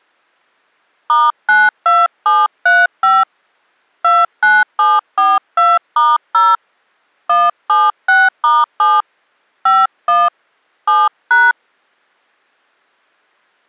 DTMF, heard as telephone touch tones, dialled by hand, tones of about 200 ms. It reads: *92735 29742*0 176*7 51 7#